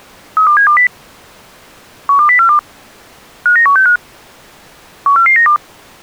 Five-tone selective call (CCIR), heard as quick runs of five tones, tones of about 100 ms. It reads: 32720 12042 59165 14492